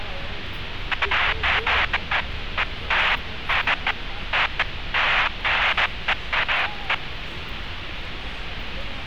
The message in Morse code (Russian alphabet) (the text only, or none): none